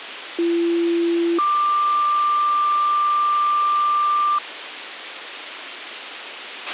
Two-tone page, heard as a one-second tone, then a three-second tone, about 340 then 1180 Hz, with radio hiss and a squelch burst at the end.